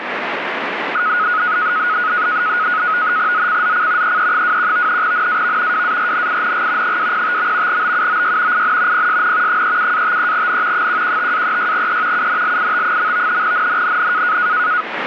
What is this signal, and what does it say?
NAVTEX (SITOR-B), 100 baud, 170 Hz shift, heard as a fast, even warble, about 1360 Hz centre, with radio static. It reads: ZCZC EE21 NAV WARNING 205. BUOY IN PSN 37-53N 115-36E UNLIT. NNNN